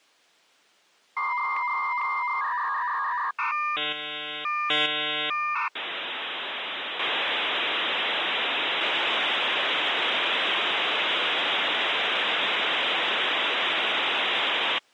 Dial-up modem handshake (V.34 or later), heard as a whistle, warbles, then hiss.